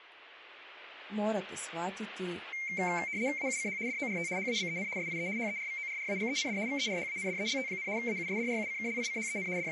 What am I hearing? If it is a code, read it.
RTTY (75 baud, 170 Hz shift), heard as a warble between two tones, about 2200 Hz centre, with radio static and speech in Croatian. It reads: AUCH DORT HABEN SIE HERVORRAGEND VERHANDELT, AUSDRUCKLICHEN …